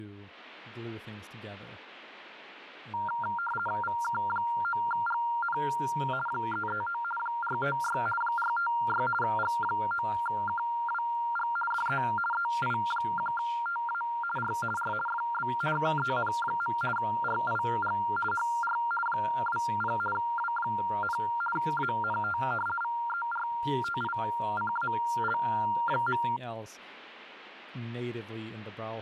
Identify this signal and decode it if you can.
RTTY (50 baud, 450 Hz shift), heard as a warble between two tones, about 1160 Hz centre, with speech in English. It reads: VK9GN 339 456 456 G9KWG DE EI1TA R R FB KEN. RIG HR 20 W, ANT VERTICAL.